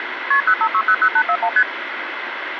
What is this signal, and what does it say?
Multi-frequency trunk signalling (R1, as on North American trunks), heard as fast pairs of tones, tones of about 70 ms, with phone line noise. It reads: KP 05600841 ST